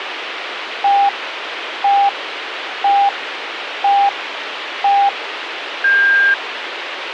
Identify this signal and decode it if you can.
Radio time signal (five pips and a higher one, as on Chinese radio), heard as pips, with radio hiss.